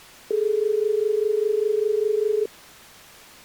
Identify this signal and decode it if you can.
Telephone call progress tone (as in Australia), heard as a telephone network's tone, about 430 Hz. Dial tone.